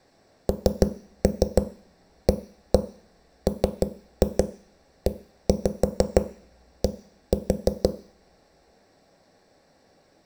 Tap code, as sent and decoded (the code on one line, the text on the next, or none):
3-3 1-1 3-2 1-5 1-4
NAMED